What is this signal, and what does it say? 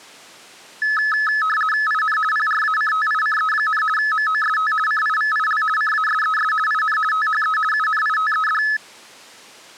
RTTY (50 baud, 450 Hz shift), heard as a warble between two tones, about 1500 Hz centre. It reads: IN PRACTICE, MOST CIVIL CASES IN THE UNITED